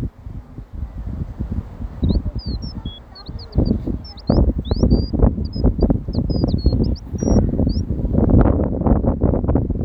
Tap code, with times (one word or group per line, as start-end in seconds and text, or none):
none